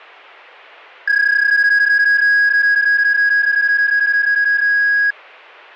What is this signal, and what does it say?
PSK31 (31.25 baud), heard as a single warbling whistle, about 1650 Hz.